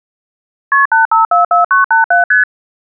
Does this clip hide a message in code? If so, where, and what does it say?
Yes: multi-frequency trunk signalling (R1, as on North American trunks) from 0.7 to 2.4 s, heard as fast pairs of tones, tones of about 140 ms. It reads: KP 8544987 ST